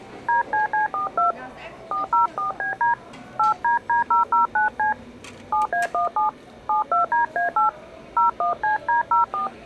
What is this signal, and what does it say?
DTMF, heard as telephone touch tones, dialled by hand, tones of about 130 ms, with the noise of a restaurant. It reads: DCC42 404BD 8DD009C 7A17 72DA8 01CD04